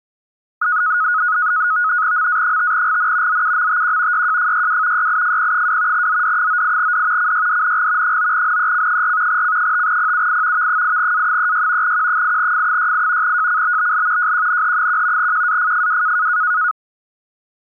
NAVTEX (SITOR-B), 100 baud, 170 Hz shift, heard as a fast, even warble, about 1360 Hz centre. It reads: MA5GN ZUMTQ YJFYW YIFP2 ZD98D CYDNG 9NEC4 C5PUI V8A36 Q8F68 JCBBL JQNH1 QAFFW